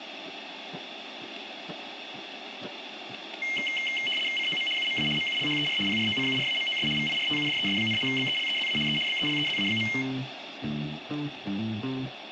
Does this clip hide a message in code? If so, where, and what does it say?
Yes: RTTY (75 baud, 850 Hz shift) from 3.4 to 10.0 s, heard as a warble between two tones, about 2550 Hz centre, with radio static and room echo. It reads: COM UMA MULHER PROCURAMOS VIRTUDES, BELEZA E BELEZA.